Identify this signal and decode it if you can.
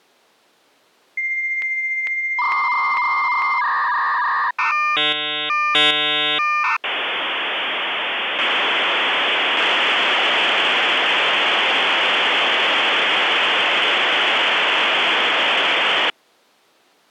Dial-up modem handshake (V.34 or later), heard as a whistle, warbles, then hiss.